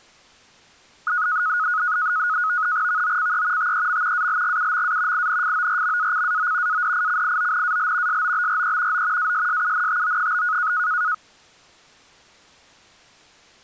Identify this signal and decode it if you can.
NAVTEX (SITOR-B), 100 baud, 170 Hz shift, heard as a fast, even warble, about 1360 Hz centre. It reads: VOCE TEM ALGUMA INFORMACAO ADICIONAL SOBRE O ASSUNTO?